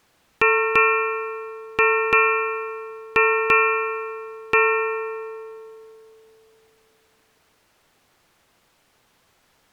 Ship's bell, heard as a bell. 7. Seven half-hours of the watch have passed.